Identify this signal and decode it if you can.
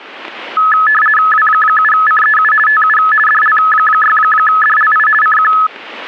RTTY (50 baud, 450 Hz shift), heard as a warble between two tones, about 1500 Hz centre. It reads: W7CEU TU DL6DLI CQ